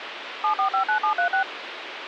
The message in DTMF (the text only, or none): 7459736